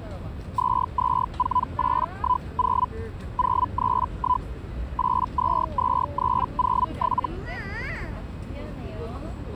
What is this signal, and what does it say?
Hellschreiber (Feld-Hell, 122.5 baud), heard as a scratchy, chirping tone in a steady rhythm, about 1000 Hz, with the noise of a residential street. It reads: 224810 031 822307